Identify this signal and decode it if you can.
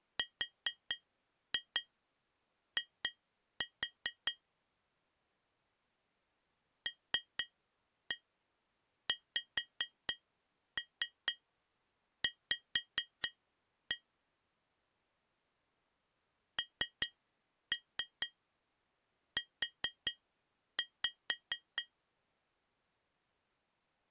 Tap code, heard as taps on glass, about 4 knocks a second. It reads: RI LXV NU